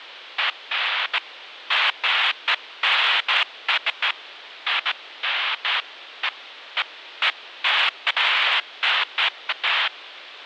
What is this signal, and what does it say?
Bursts of noise, with radio static. There is no code.